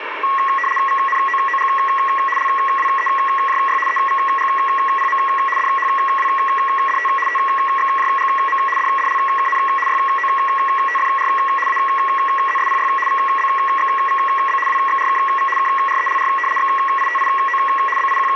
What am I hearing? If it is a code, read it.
RTTY (75 baud, 850 Hz shift), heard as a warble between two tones, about 1500 Hz centre, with radio static. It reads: VNOOG LWEJY EVGPM DHWDT TXJGM DDLKN YOTFR AZSPY VBXVB WXRKV KRELR XITIO …